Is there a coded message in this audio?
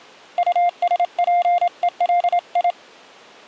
Yes: Morse code (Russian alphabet) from 0.3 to 2.8 s, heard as a keyed tone, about 27 wpm, 700 Hz. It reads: УСПЕЛИ